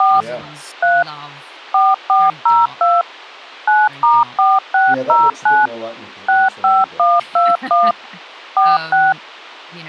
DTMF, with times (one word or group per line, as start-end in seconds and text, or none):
0.0-0.2 4
0.8-1.0 3
1.7-3.0 4402
3.7-5.7 9*4609
6.3-7.9 65121
8.6-9.1 46